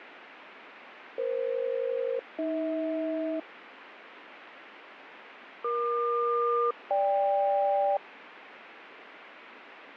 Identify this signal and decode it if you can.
Aircraft SELCAL, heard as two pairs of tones, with radio static. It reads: EF-AH EQ-GK